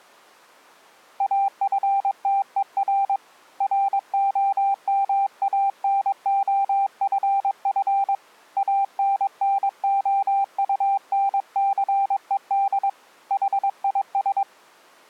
Morse code, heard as a keyed tone, hand-sent with a paddle, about 22 wpm, 790 Hz. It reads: AFTER ROMANOFF ANNOUNCED HIS